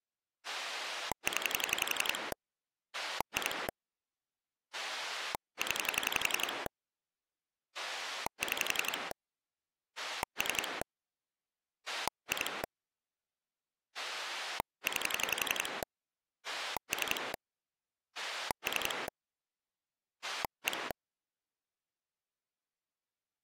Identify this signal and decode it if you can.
Pulse dialling, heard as a rotary dial, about 11 pulses a second. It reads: 0 2 0 6 3 2 9 3 3 1